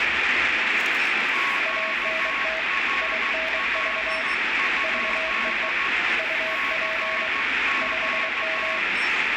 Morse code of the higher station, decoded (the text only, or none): QRL? CQ